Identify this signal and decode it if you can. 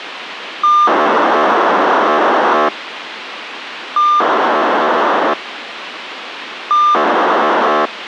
POCSAG pager data (2400 baud), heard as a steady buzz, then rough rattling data, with radio hiss.